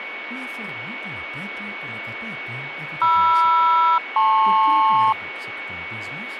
Aircraft SELCAL, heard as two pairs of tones, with radio static and a steady whistle near 2230 Hz. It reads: MR-LP